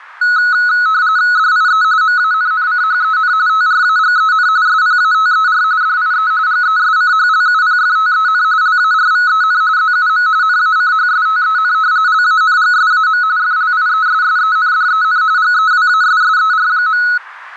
RTTY (45.45 baud, 170 Hz shift), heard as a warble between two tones, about 1380 Hz centre, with radio static. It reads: DIE MANNCHEN TRAGEN SPATER DIE GESCHLUPFTEN LARVEN ZUM NACHSTEN LANGSAM FLIESSENDEN GEWASSER.